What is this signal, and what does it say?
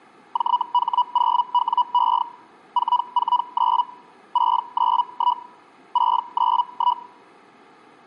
Hellschreiber (Feld-Hell, 122.5 baud), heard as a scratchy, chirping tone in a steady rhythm, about 980 Hz. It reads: JH0WE 449 691 691